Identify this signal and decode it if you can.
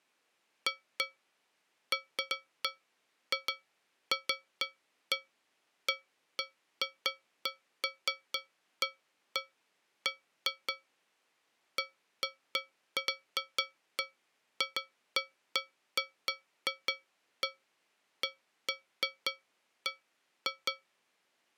Irregular taps on a metal pipe. There is no code.